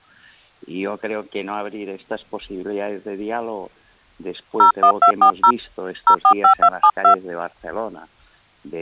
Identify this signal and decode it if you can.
DTMF, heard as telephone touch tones, dialled by hand, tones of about 90 ms. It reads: 01240 045272